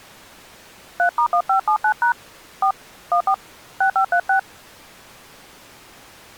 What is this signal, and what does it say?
DTMF, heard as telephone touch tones, dialled by hand, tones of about 90 ms. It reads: 3*1579# 4 14 6536